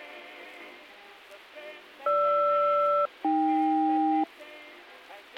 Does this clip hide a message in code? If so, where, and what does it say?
Yes: aircraft SELCAL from 2.1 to 4.2 s, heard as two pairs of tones, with a squelch burst at the end. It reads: GR-AK